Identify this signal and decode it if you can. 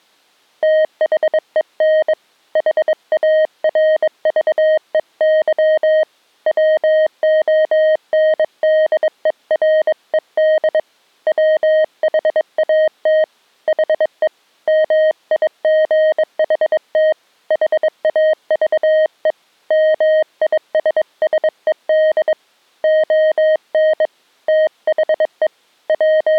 Morse code, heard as a keyed tone, hand-sent with a bug key, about 22 wpm, 620 Hz. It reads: THEN HARVEY WONDERED WHAT HE MIGHT HAVE MISSED ON THE …